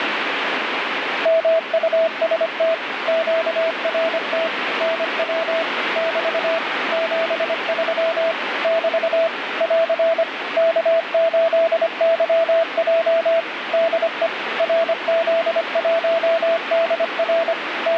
Morse code, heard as a keyed tone, machine-sent, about 25 wpm, 660 Hz, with radio static. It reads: MUST QRT NW <BT> 73 <BT> <AR> K8YJ DE RZ1DR …